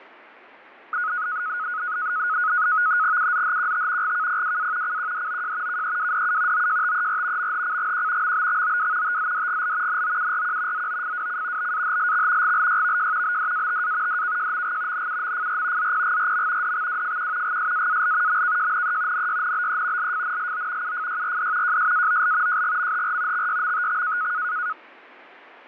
NAVTEX (SITOR-B), 100 baud, 170 Hz shift, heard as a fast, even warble, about 1360 Hz centre. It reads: UZHQT GKPWA CQDOJ KEWDU OJTER MHCGQ MBXOW TZDGL NOURQ ZOFWC BAHLX GLYVJ BDATA DKJMG NUMFR ZPGRM DXWFQ GSAAL MKJNE NYNBE LFNLO UFYRD JSAOL JGMHR XYMTX